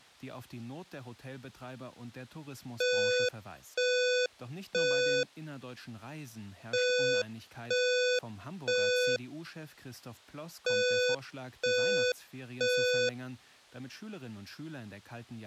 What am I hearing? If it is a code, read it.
Alarm pattern, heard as an alarm's beeps, played three times, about 500 Hz, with speech in German. Temporal three. Smoke or fire, evacuate.